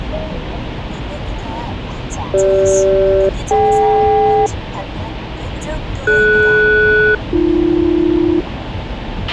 Aircraft SELCAL, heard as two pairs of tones, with a squelch burst at the end and the noise inside a car. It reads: CG-DK DS-AB